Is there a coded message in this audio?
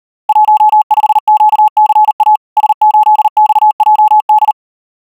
Yes: Morse code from 0.2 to 4.6 s, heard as a keyed tone, machine-sent, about 39 wpm, 850 Hz. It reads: 15QCA S8XJD